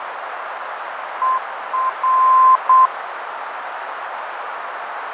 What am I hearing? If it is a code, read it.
Morse code, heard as a keyed tone, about 8 wpm, 1040 Hz, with radio static, fading and a narrow filter. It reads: ER